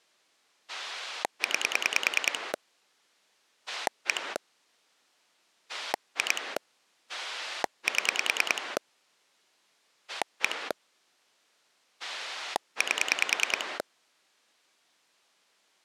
Pulse dialling, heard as a rotary dial, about 10 pulses a second. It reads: 9 1 2 7 1 8